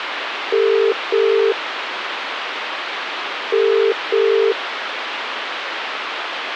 Telephone call progress tone (as in the UK, Ireland, Australia and similar networks), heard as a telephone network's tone, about 400, 450 Hz, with phone line noise. Ringback tone.